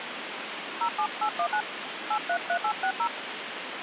DTMF, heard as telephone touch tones, dialled by hand, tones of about 80 ms, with phone line noise. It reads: 07819 833860